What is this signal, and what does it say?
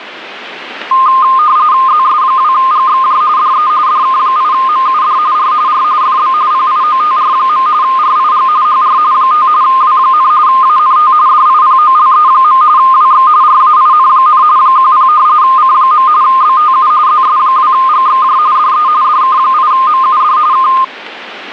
RTTY (45.45 baud, 170 Hz shift), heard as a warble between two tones, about 1140 Hz centre. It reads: ZS2GXJ DE DK8MUD R R FB PIOTR. RIG HR 5 W, ANT DIPOLE. WX RAIN, 10 C. BTU ZS2GXJ DE DK8MUD K